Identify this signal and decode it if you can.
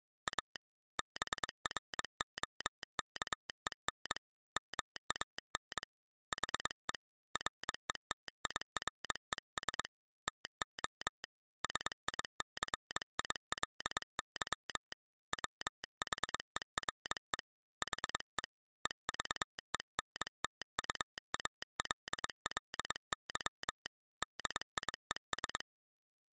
Morse code, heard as a telegraph sounder, hand-sent with a paddle, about 22 wpm. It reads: A BROKEN MAN HE RETIRES TO SICILY WHERE HE EVENTUALLY DIES